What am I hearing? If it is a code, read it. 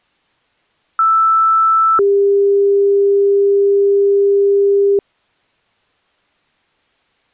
Two-tone page, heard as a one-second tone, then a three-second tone, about 1320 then 400 Hz.